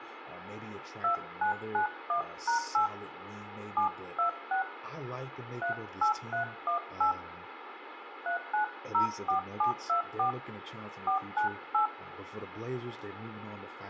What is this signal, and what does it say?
DTMF, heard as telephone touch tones, dialled by hand, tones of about 110 ms, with phone line noise, room echo and speech in English. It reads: 2991#8 726 38318 3904724 498